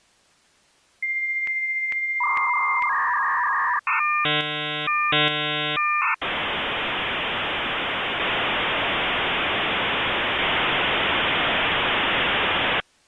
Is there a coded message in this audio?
Yes: dial-up modem handshake (V.34 or later) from 1.0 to 12.8 s, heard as a whistle, warbles, then hiss.